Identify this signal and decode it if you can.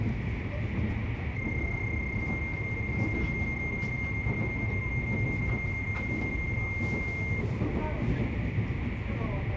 PSK31 (31.25 baud), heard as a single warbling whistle, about 2100 Hz, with radio static, a narrow filter and the noise inside a subway train.